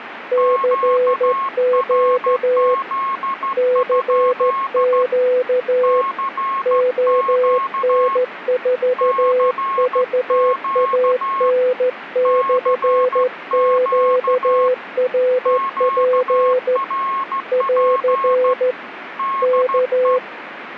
Morse code, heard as two keyed tones, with radio static. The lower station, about 14 wpm, 500 Hz: CQ CQ ON4VAN/QRP <AR> K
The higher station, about 14 wpm, 1080 Hz: QRZ? CQ CQ CQ QRP DE